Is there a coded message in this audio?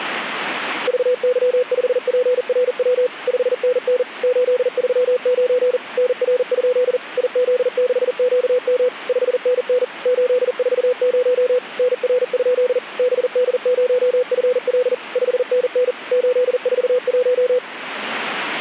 Yes: Morse code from 0.8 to 17.6 s, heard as a keyed tone, machine-sent, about 40 wpm, 500 Hz. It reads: VY5PRW 5NN 839 NR? IZ6QM 5NN 840 NR? BD0FL 5NN 841